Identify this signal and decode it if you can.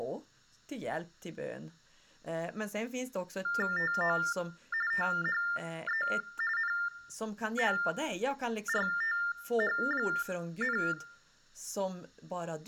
TTY/TDD text telephone tones (45.45 baud Baudot), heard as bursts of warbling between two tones, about 400 Hz shift, 1600 Hz centre, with speech in Swedish. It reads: TO THE NORTH,